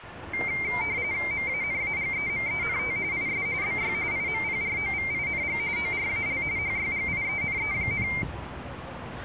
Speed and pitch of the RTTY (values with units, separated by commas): 45.45 baud, 170 Hz shift, 2200 Hz centre